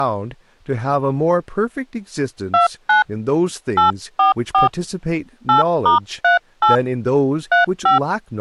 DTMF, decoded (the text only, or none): 29 844 8*38 35